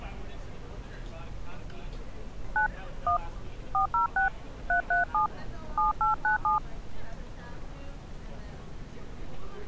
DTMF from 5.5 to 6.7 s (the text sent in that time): 7897